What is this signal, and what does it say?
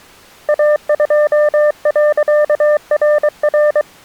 Morse code, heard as a keyed tone, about 23 wpm, 600 Hz. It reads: A2.RR